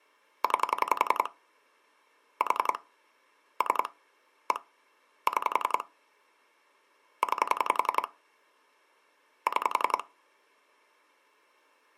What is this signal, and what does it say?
Pulse dialling, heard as clicks on a phone line, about 11 pulses a second. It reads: 9 4 3 1 6 9 6